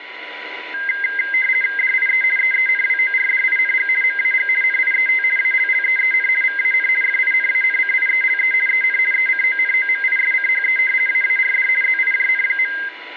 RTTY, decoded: DIE EENWORDING MAG NIET ALLEEN VAN FINANCIELE EN ECONOMISCHE AARD ZIJN.

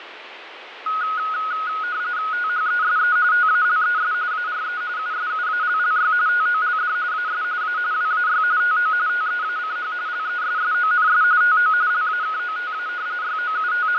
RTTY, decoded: THESE TALES ARE USUALLY TOLD AS A WAY TO TEACH LESSONS TO LAKOTA …

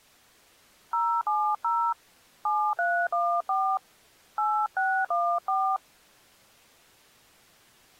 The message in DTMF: 070 7314 8614

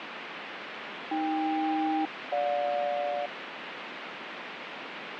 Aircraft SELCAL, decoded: AK-GJ

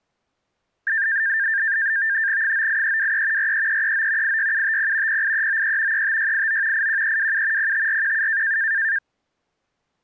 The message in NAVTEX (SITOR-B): 98323 43339 86750 08393 35689 81327 05417

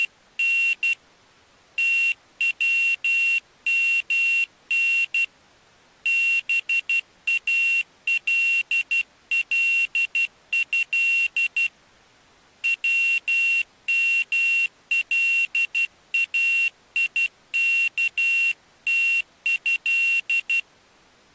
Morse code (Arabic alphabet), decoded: … تومن بالله وملايكته

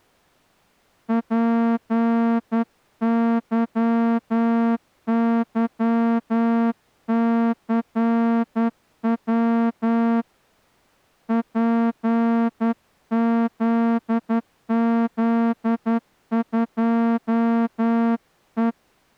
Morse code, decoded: PYYCW PZZ2E

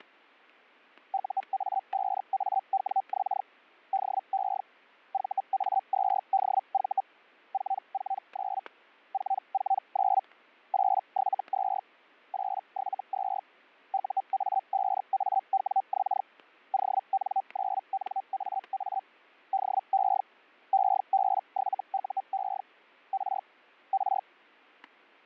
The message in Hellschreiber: UA5AWX DE VA2DV 449 449 872 872 UA5AWX ON9NAA DE EB7UE R R

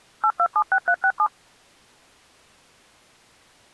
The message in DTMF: 8276367

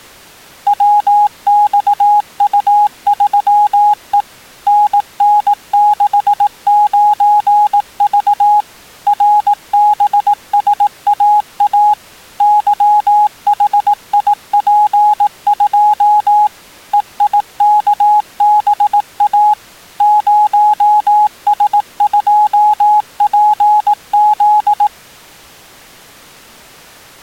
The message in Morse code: WXU3E NN69V RBSAA YHIP2 EIKBA 0S2PZ

